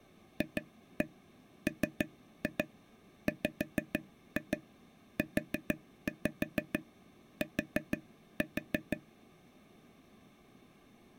Tap code, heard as taps on a table, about 6 knocks a second. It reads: FMWUT